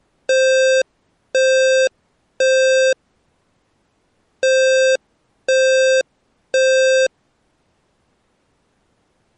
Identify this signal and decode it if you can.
Alarm pattern, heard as an alarm's beeps, played twice, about 520 Hz. Temporal three. Smoke or fire, evacuate.